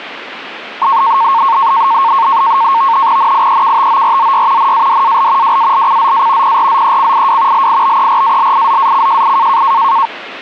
NAVTEX (SITOR-B), 100 baud, 170 Hz shift, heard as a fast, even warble, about 1000 Hz centre. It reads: NIEKTORZY NADAL WALCZA PRZECIW LIBERALIZACJI